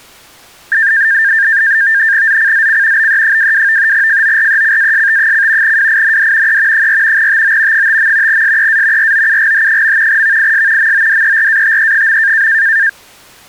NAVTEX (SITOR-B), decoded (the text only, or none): ZCZC BE22 FORECAST: WIND E 4 TO 5. SEA ROUGH. VIS MODERATE.